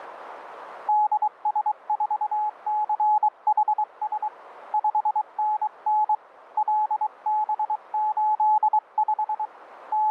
Morse code, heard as a keyed tone, hand-sent with a paddle, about 23 wpm, 850 Hz, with radio static. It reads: DS4CHS 5NN LB85 …